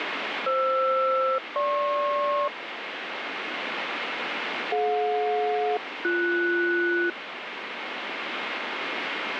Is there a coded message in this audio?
Yes: aircraft SELCAL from 0.5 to 7.1 s, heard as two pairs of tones, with radio static. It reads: FR-GP DJ-BS